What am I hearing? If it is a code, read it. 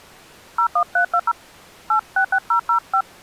DTMF, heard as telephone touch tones, dialled by hand, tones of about 70 ms. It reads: 01320 866005